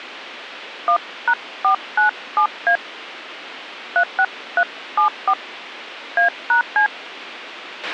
DTMF, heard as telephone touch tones, dialled by hand, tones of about 100 ms, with a squelch burst at the end. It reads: 1#497A 36374 A#C